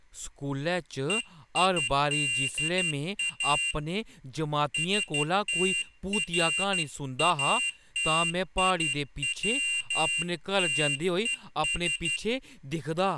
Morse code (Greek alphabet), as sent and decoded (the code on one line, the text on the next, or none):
. .. -.. .- / ... - .-. .- - .. .-- - . ...
ΕΙΔΑ ΣΤΡΑΤΙΩΤΕΣ